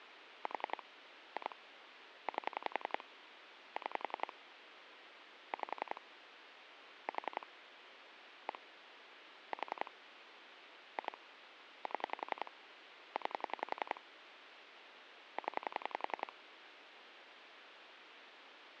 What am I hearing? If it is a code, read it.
Pulse dialling, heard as clicks on a phone line, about 11 pulses a second, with phone line noise. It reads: 4 2 8 6 5 4 1 4 2 7 9 0